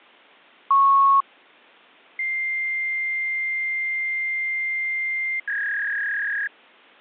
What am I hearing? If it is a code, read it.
Fax machine handshake, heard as a beep, a long tone and a warble.